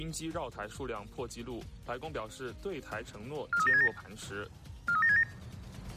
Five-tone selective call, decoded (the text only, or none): 43767 43767